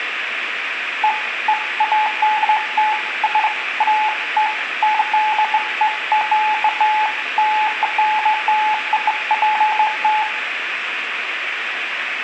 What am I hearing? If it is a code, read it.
Beeps of irregular length, with room echo. There is no code.